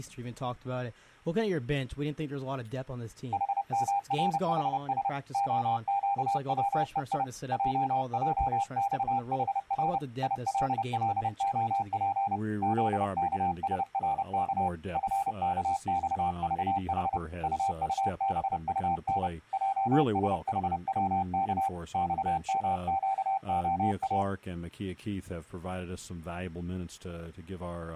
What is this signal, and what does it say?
Morse code, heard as a keyed tone, hand-sent with a paddle, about 30 wpm, 790 Hz. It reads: HMRHS OQWEI JJXHR ILLOP ZKSRK FKXVH UUBUN JSHWK XMQOA